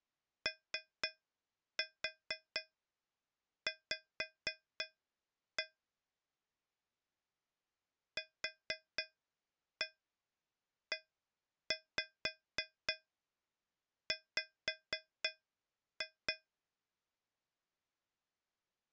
Tap code, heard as taps on a metal pipe, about 4 knocks a second. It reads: OV QEW